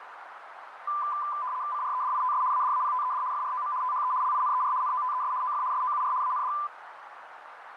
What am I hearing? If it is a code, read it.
RTTY (75 baud, 170 Hz shift), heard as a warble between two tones, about 1100 Hz centre, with radio static and a narrow filter. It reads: CREDITS ADAPTED FROM THE LINER NOTES OF SOUR AND